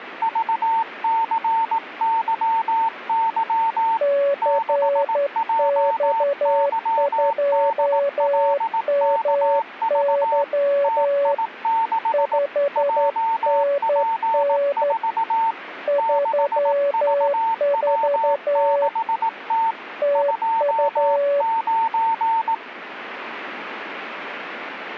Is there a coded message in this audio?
Yes: Morse code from 0.2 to 22.6 s, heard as two keyed tones. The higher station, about 18 wpm, 900 Hz: VCYY 6JYDLKV TI6 JP4 6VW6T 29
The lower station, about 11 wpm, 570 Hz: CX2MY 5NN 34 TU